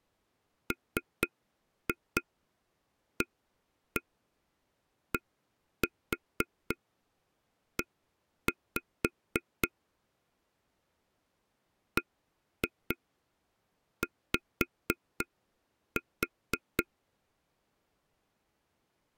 Tap code, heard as taps on a table, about 4 knocks a second. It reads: MADE BY